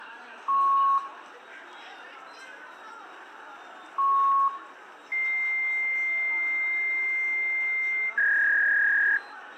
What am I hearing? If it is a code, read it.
Fax machine handshake, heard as beeps, a long tone and a warble, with room echo and the noise of a subway station.